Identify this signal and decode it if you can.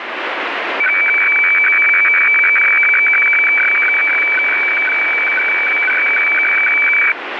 Weather fax (radiofax), 120 lines a minute, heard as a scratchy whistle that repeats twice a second, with radio static.